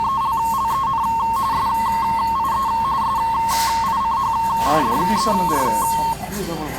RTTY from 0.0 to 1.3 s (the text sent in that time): …